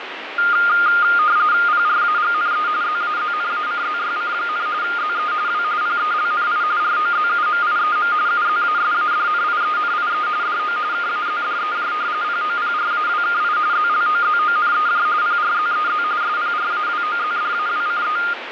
RTTY (45.45 baud, 170 Hz shift), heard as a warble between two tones, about 1320 Hz centre, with radio static. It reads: PRAGNE ZAZNACZYC, ZE W PELNI ROZUMIEM UZASADNIENIE DO KAZDEJ POPRAWKI ZLOZONEJ PRZEZ SPRAWOZDAWCE